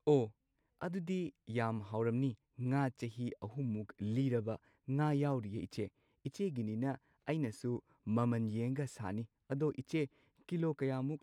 Speech in Manipuri. There is no code.